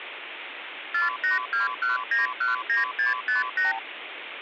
Multi-frequency trunk signalling (R2, with the far end's replies), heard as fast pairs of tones, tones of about 150 ms, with phone line noise. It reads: 4821919658